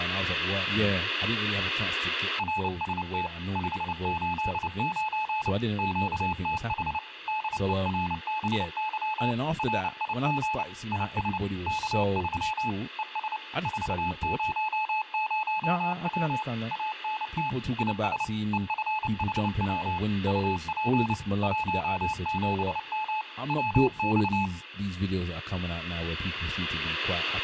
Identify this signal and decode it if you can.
Morse code, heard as a keyed tone, machine-sent, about 29 wpm, 860 Hz, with speech in English. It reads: RST 589 QTH DERBY RIG IS K3 ES 400W ANT IS EFHW UP 17M WX